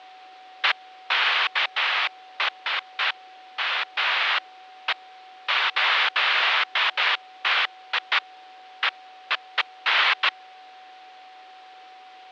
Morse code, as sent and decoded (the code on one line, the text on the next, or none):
none